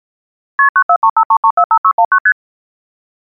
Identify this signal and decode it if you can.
Multi-frequency trunk signalling (R1, as on North American trunks), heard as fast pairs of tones, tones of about 70 ms. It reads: KP 94353345619 ST